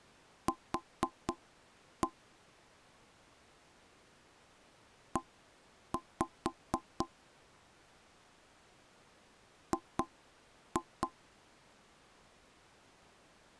Tap code, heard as knocks on wood, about 4 knocks a second. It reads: Q E G